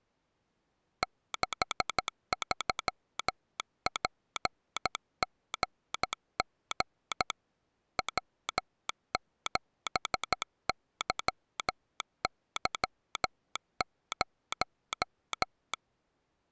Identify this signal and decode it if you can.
Morse code, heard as a telegraph sounder, hand-sent with a paddle, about 13 wpm. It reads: 63PGG W7YY0